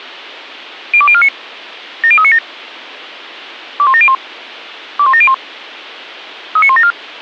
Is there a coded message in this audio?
Yes: five-tone selective call (ZVEI) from 0.9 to 6.9 s, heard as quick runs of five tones, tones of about 70 ms. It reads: 02049 70397 21701 21701 39174